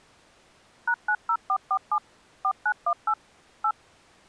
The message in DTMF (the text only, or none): #90447 4918 8